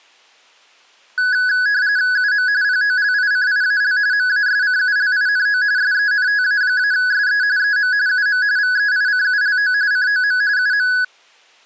RTTY (45.45 baud, 170 Hz shift), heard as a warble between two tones, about 1600 Hz centre. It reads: UM POLICIAL MASCULINO SENTA-SE EM UM VEICULO COM UM